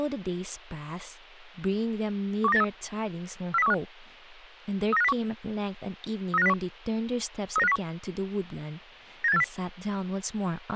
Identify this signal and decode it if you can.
Five-tone selective call (EEA), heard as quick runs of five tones, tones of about 40 ms, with speech in English. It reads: 12983 40315 39501 39501 39501 97840